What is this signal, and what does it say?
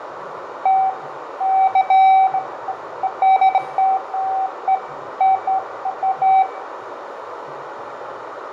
Beeps of irregular length, with radio static, fading, a narrow filter, room echo and the noise of a crowd indoors. There is no code.